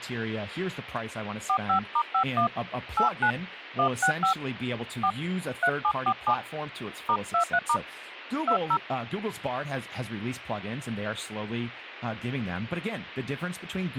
DTMF, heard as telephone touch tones, dialled by hand, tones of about 90 ms, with speech in English. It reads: 45*51 89 165 4 3747 *23* 20